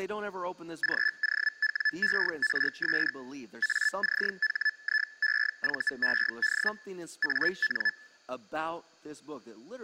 Hellschreiber (Feld-Hell, 122.5 baud), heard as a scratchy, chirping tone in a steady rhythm, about 1750 Hz, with speech in English. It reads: GOWERS ACHIEVED AN